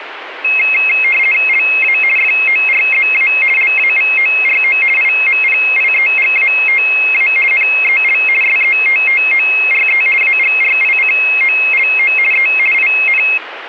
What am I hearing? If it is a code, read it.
RTTY (50 baud, 450 Hz shift), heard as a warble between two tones, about 2350 Hz centre, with radio static. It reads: LA FORZA LAVORO IMPIEGATA NEL SETTORE AGRICOLO E IN